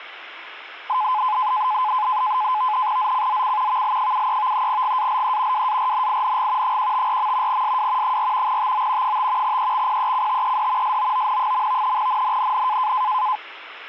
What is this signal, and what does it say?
NAVTEX (SITOR-B), 100 baud, 170 Hz shift, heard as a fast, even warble, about 940 Hz centre. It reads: ZCZC VL73 GALE WARNING 154. SW 4 TO 5 EXPECTED SOON. NNNN